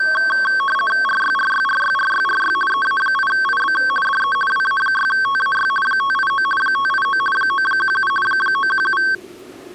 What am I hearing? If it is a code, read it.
RTTY (50 baud, 450 Hz shift), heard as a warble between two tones, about 1330 Hz centre, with the noise of a subway station. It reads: RYRYRYRYRY EA8IB DE WA6TAY 589 589 917 917